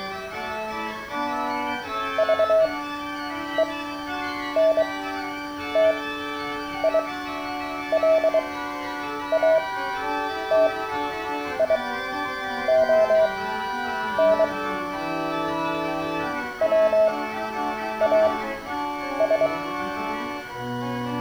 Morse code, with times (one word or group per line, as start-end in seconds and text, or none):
2.2-14.4 VENTILATION
16.6-19.5 WAS